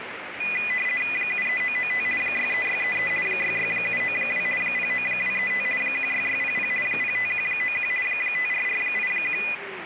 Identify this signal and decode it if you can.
RTTY (50 baud, 450 Hz shift), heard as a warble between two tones, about 2250 Hz centre, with radio static and the noise of a cafe. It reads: 73995 63633 66792 09235 16600 05191 54481